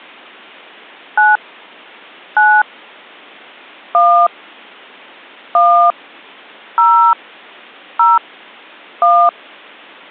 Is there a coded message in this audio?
Yes: DTMF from 1.2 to 9.3 s, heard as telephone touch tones, dialled by hand, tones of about 280 ms. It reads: 9 9 1 1 0 0 1